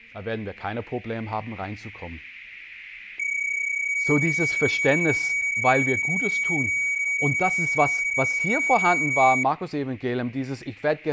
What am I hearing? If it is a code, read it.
PSK31 (31.25 baud), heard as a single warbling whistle, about 2250 Hz, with speech in German.